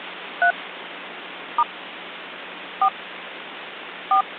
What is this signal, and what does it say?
DTMF, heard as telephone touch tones, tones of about 80 ms, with phone line noise. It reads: 3 * 4 4